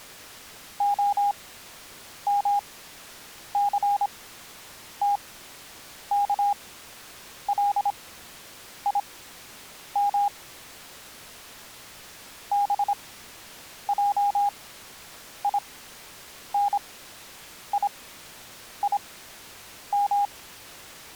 Morse code (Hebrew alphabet), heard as a keyed tone, machine-sent, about 26 wpm, spaced as for 8 wpm, 810 Hz. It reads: המסתכלים בעיניים